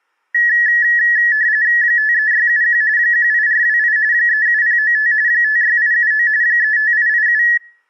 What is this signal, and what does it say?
RTTY (45.45 baud, 170 Hz shift), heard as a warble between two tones, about 1800 Hz centre. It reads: 53671 18428 37095 56879 35887